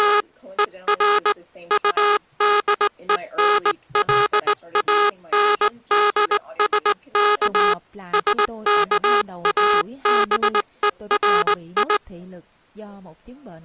Morse code, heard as a buzzer, hand-sent with a straight key, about 19 wpm. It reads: … ER UDENLANDSK SKABERI